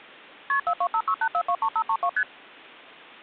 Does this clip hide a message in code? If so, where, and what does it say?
Yes: multi-frequency trunk signalling (R1, as on North American trunks) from 0.5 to 2.2 s, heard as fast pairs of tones, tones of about 70 ms. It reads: KP 42568423532 ST